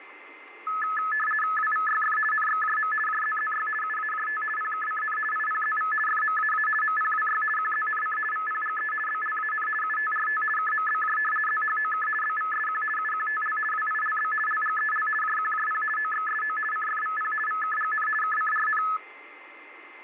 RTTY (50 baud, 450 Hz shift), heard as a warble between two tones, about 1500 Hz centre, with a steady whistle near 2080 Hz. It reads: WVYF NXJM JZZY UAJT PKCN IPZV FMAA MPWY QZNC VPGE BLAN UTRT KMBJ ZHOK BVSQ UQTL WILB LGEL JQJP OXSO CFVP VKGN KCRN